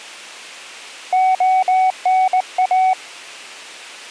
Morse code (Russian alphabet), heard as a keyed tone, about 19 wpm, 750 Hz. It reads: ОНА